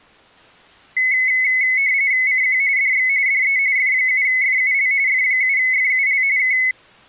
RTTY (45.45 baud, 170 Hz shift), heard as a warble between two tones, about 2100 Hz centre. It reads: CQ DX DE F7FUL F7FUL K